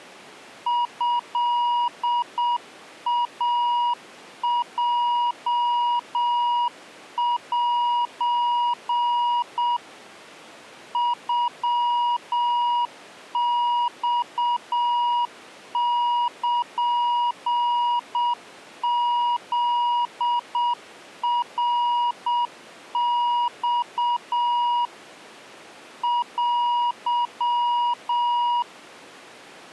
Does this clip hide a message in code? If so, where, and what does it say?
Yes: Morse code (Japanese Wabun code) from 0.6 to 28.7 s, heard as a keyed tone, machine-sent, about 7 wpm, 960 Hz. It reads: トイヲセ ノマルフナマ テ